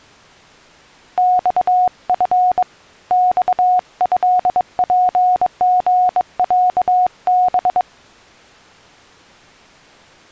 Morse code (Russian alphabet), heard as a keyed tone, hand-sent with a bug key, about 22 wpm, 730 Hz. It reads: ЬФ ЬЭПГЯБ